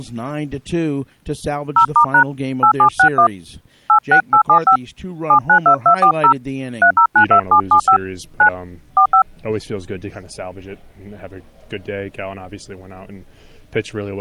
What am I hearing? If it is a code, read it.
DTMF, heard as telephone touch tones, dialled by hand, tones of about 90 ms. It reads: 0*# 8761 86875 792240 3092775 9 45